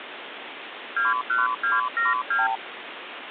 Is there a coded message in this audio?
Yes: multi-frequency trunk signalling (R2, with the far end's replies) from 1.0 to 2.6 s, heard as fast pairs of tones, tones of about 170 ms, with phone line noise. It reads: 21272